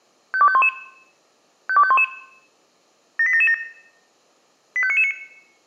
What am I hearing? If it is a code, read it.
Five-tone selective call (ZVEI), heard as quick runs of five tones, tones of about 70 ms, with room echo. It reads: 52511 52511 78777 85999